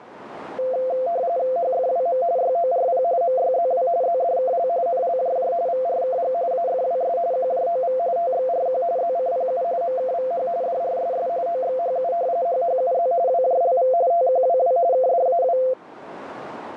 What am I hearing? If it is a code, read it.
RTTY (45.45 baud, 170 Hz shift), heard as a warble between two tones, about 600 Hz centre, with radio static and a narrow filter. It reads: HFWM YORP MYZW ZDKL NLJJ VRKG AFWS QJOV TXRQ ZCPU MKVH DRSS OXHU HHUZ WJLV TQWW KDAW